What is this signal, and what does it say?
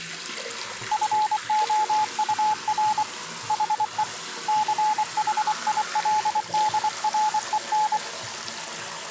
Morse code, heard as a keyed tone, hand-sent with a paddle, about 24 wpm, 860 Hz, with the noise of a restroom. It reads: FOUR HE CHILDREN